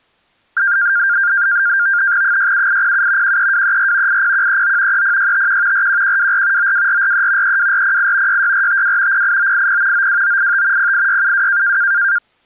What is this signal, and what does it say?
NAVTEX (SITOR-B), 100 baud, 170 Hz shift, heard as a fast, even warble, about 1500 Hz centre. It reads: 67807 13234 80139 30651 41124 92443 32408 66452 08980 92985 08672